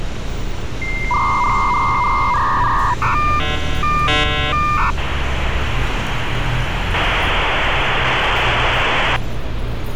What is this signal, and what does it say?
Dial-up modem handshake (V.34 or later), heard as a whistle, warbles, then hiss, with phone line noise and street noise.